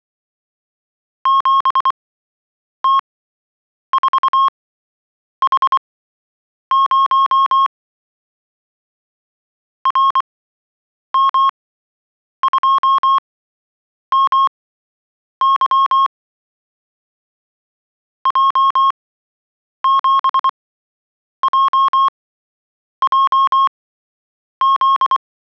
Morse code, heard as a keyed tone, machine-sent, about 24 wpm, spaced as for 8 wpm, 1090 Hz. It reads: 7T4H0 RM2MY J7JJZ